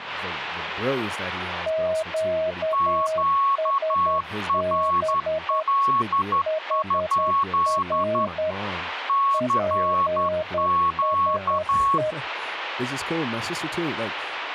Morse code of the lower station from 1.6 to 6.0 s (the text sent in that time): QSB